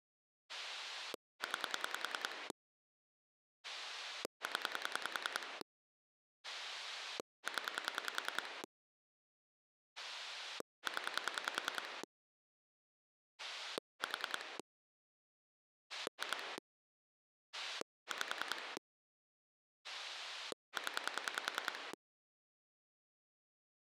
Pulse dialling, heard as a rotary dial, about 10 pulses a second. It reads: 9 0 0 0 4 2 5 0